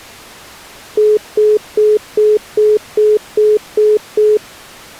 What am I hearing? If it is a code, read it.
Telephone call progress tone (single-tone plan, as in most of Europe), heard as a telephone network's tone, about 420 Hz, 0.2 s on and 0.2 s off. Congestion tone.